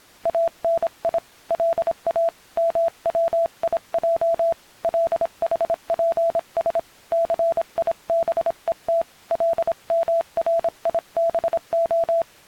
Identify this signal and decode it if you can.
Morse code (Hebrew alphabet), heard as a keyed tone, hand-sent with a paddle, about 26 wpm, 670 Hz. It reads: אני לא מציע לחפש סיבות למריבה